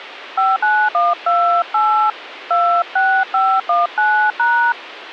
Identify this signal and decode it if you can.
DTMF, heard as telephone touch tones, dialled by hand, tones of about 250 ms, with radio hiss. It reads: 59128 26519#